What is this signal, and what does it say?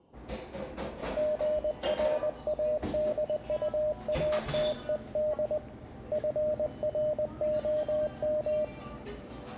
Morse code, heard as a keyed tone, hand-sent with a paddle, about 20 wpm, 610 Hz, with room echo and the noise of a cafe. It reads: GRADUATED FROM